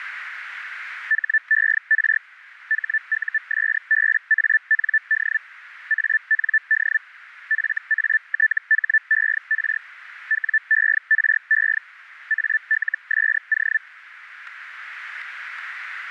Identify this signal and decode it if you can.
Hellschreiber (Feld-Hell, 122.5 baud), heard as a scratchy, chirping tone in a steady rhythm, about 1750 Hz, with radio static. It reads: HER HUSBAND AND FATHER WERE ALSO